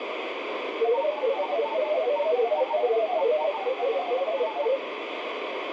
Multi-tone FSK (Olivia or MFSK type), about 500 Hz wide, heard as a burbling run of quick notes, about 31.25 baud, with radio static and room echo.